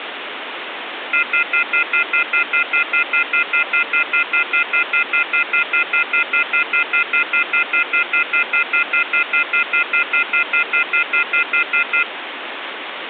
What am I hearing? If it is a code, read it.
Telephone call progress tone (North American plan), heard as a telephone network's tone, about 1400, 2050, 2450, 2600 Hz, 0.1 s on and 0.1 s off, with phone line noise. Off-hook warning tone.